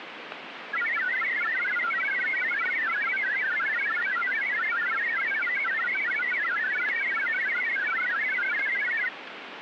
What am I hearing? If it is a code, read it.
Multi-tone FSK (Olivia or MFSK type), about 1000 Hz wide, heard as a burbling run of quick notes, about 62.5 baud, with radio static.